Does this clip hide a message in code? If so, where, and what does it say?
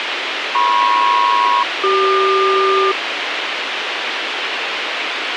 Yes: aircraft SELCAL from 0.5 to 2.9 s, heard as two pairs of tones, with radio hiss. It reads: MP-CQ